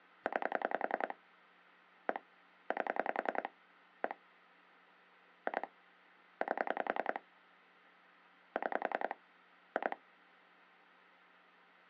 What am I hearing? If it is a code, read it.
Pulse dialling, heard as clicks on a phone line, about 10 pulses a second. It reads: 9 1 8 1 2 8 6 2